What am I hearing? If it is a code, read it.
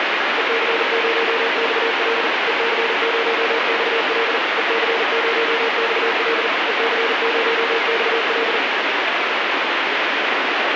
Morse code, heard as a keyed tone, machine-sent, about 40 wpm, 460 Hz, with heavy radio static. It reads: EC0XL EC0XL EC0XL EC0XL